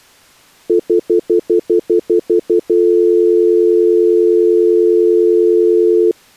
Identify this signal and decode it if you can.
Telephone call progress tone (North American plan), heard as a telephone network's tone, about 350, 440 Hz, 0.1 s on and 0.1 s off. Stutter dial tone.